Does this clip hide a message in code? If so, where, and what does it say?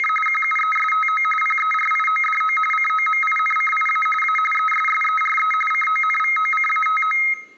Yes: RTTY (45.45 baud, 850 Hz shift) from 0.0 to 7.3 s, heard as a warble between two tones, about 1700 Hz centre, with room echo. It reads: … QUESTO PERIODO COMINCIA A ESSERE CONVOCATO